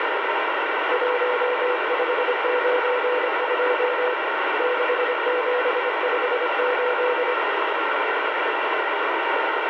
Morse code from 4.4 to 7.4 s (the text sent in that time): 6758